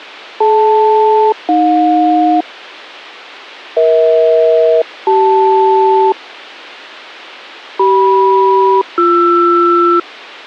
Aircraft SELCAL, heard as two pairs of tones. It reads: DL-AJ EH-CL CM-BR